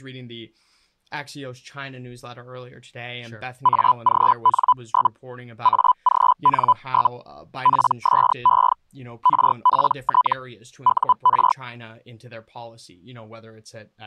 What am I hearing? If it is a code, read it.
Hellschreiber (Feld-Hell, 122.5 baud), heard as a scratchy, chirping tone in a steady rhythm, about 1000 Hz, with speech in English. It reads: AGN? AGN? PSE RPT UR